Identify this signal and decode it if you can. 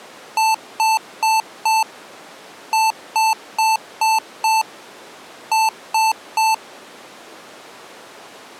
Beep code, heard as beeps from a small speaker, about 880 Hz. 4-5-3.